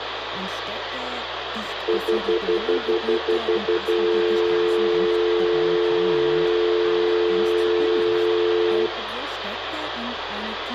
Telephone call progress tone (North American plan), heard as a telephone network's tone, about 350, 440 Hz, 0.1 s on and 0.1 s off, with phone line noise and room echo. Stutter dial tone.